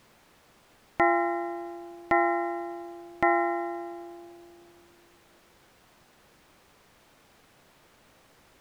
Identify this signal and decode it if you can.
Clock strike, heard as a bell. 3. Three o'clock.